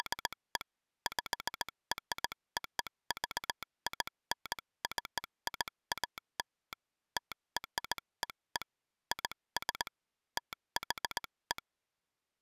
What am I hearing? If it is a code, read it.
Morse code (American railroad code), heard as a telegraph sounder, hand-sent with a straight key. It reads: … PROVINCIAL TREE IS THE